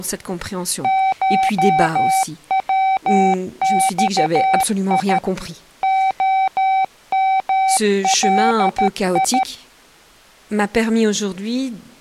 Morse code (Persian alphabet), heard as a keyed tone, machine-sent, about 13 wpm, 770 Hz, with speech in French. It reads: شوخی عملی